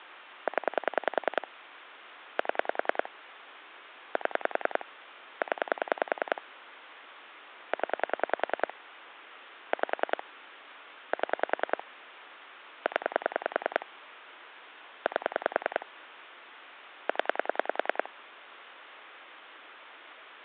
Pulse dialling, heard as clicks on a phone line, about 10 pulses a second. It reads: 0 7 7 0 0 5 7 0 8 0